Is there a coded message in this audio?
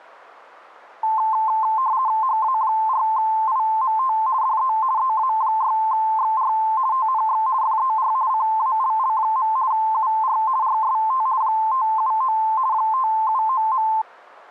Yes: RTTY (50 baud, 170 Hz shift) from 1.0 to 14.0 s, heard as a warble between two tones, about 960 Hz centre. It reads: HA4IMT DE EA6XR TNX FER CALL. UR RST 579 579.